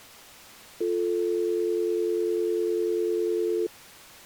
Telephone call progress tone (North American or UK plan), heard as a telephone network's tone, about 350, 440 Hz. Dial tone.